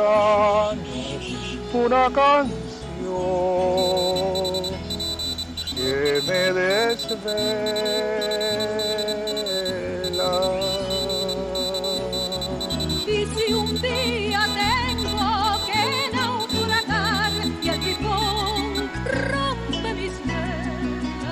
Morse code (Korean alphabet), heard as a high beeper, machine-sent, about 25 wpm, 3950 Hz, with room echo. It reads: 수집되는 것을 거부합니다